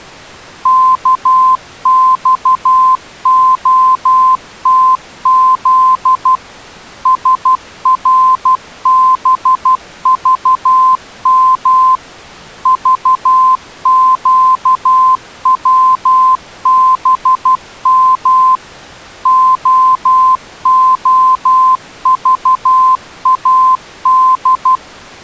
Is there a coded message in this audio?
Yes: Morse code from 0.6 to 24.8 s, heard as a keyed tone, machine-sent, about 12 wpm, 1040 Hz. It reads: KXOTZ SRBVM VQWBM OOVAD